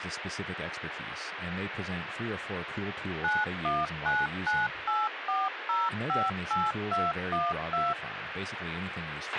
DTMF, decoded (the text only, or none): 919984058212